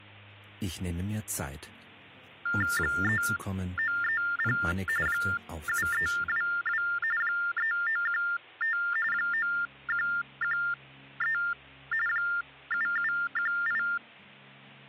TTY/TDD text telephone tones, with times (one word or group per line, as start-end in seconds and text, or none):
2.8-4.6 3930
5.1-6.8 7322
7.2-8.8 3915
9.1-11.4 9113
12.1-13.8 7718